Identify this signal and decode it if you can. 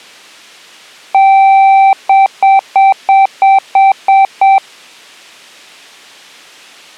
Beep code, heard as beeps, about 780 Hz. 1 long, 8 short. In AMI BIOS tables: display or retrace test failure.